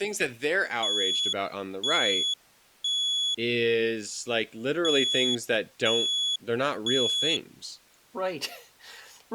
Alarm pattern, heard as an alarm's beeps, played twice, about 3400 Hz, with speech in English. Temporal three. Smoke or fire, evacuate.